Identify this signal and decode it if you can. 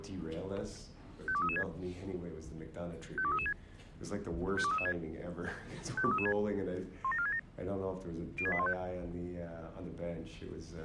Five-tone selective call (ZVEI), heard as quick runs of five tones, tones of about 70 ms. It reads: 52336 52336 52336 52336 17467 06815